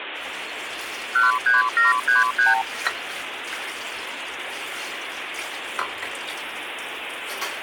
Multi-frequency trunk signalling (R2, with the far end's replies), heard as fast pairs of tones, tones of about 150 ms, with phone line noise and kitchen noise. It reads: 13733